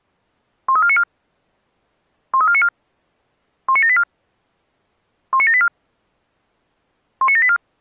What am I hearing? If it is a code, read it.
Five-tone selective call (ZVEI), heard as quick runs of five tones, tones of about 70 ms. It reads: 13494 13494 19784 19784 19784